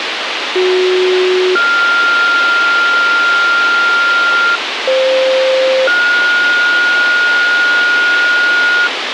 Two-tone page, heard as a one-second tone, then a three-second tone, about 370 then 1400 Hz, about 520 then 1430 Hz, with radio hiss.